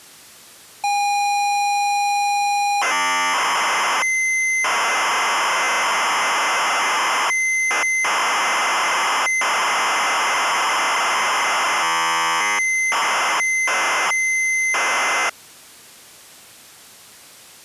ZX Spectrum tape loading, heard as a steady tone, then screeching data.